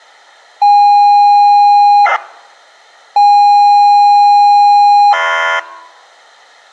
ZX Spectrum tape loading, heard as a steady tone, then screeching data.